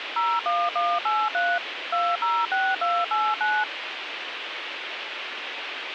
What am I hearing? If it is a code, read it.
DTMF, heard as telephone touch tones, dialled by machine, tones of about 240 ms, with radio hiss. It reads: 01183 206289